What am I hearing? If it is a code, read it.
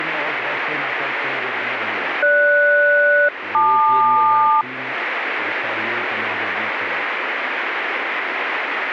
Aircraft SELCAL, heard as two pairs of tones, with radio static. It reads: GS-LQ